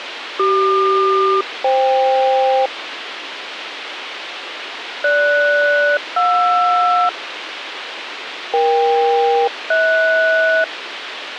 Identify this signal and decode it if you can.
Aircraft SELCAL, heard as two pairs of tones, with radio hiss. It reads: CQ-FK GS-JR EK-HS